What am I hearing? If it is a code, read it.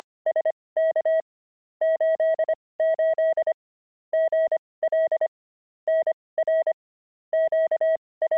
Morse code, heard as a keyed tone, machine-sent, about 25 wpm, spaced as for 19 wpm, 640 Hz. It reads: … 88 GL NR …